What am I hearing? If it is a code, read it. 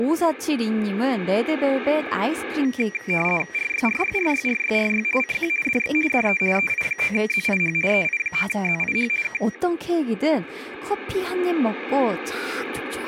RTTY (50 baud, 450 Hz shift), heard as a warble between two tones, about 2150 Hz centre, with radio static and speech in Korean. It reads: RYRYRYRYRY CQ DX DE EI9ZIH EI9ZIH K